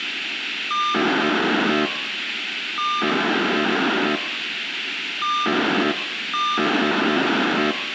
POCSAG pager data (2400 baud), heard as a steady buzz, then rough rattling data, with radio hiss.